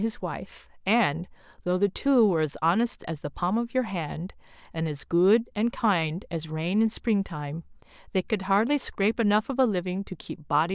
Speech in English. There is no code.